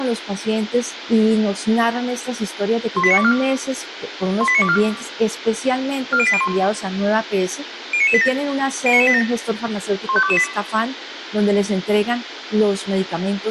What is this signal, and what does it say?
Five-tone selective call (ZVEI), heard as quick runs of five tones, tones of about 70 ms, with radio hiss and room echo. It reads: 18924 18924 40801 09987 09987 15228